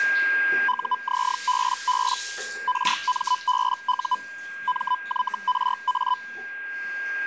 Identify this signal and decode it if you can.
Hellschreiber (Feld-Hell, 122.5 baud), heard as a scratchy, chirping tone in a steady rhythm, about 1000 Hz, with a steady whistle near 1610 Hz and the noise of a restroom. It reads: UZBB RMBU MYRA